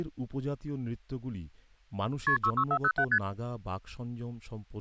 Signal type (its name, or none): multi-frequency trunk signalling